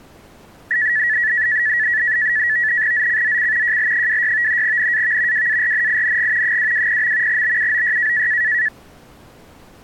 NAVTEX (SITOR-B), 100 baud, 170 Hz shift, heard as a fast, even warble, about 1800 Hz centre. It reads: ZCZC JL26 NAV WARNING 220. BUOY